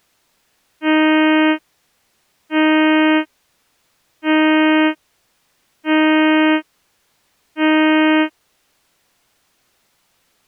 Ship horn signal, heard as a ship's horn, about 310 Hz. 5 short. At sea: I doubt that you are doing enough to avoid a collision.